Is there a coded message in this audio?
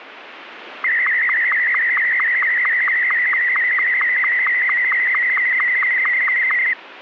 Yes: SSTV (slow-scan television), Martin M2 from 0.8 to 6.7 s, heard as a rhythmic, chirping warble.